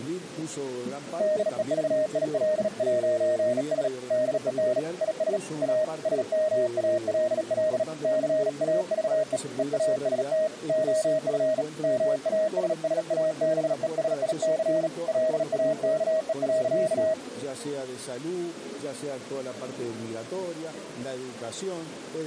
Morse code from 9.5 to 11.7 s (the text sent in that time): EAST OF